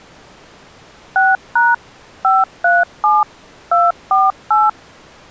DTMF, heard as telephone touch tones, dialled by machine, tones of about 190 ms. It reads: 6# 537 248